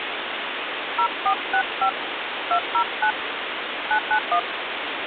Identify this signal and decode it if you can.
DTMF, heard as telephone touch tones, dialled by hand, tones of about 80 ms, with phone line noise. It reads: 0465 209 991